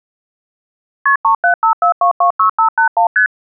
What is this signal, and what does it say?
Multi-frequency trunk signalling (R1, as on North American trunks), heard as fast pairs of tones, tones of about 100 ms. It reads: KP 3754226581 ST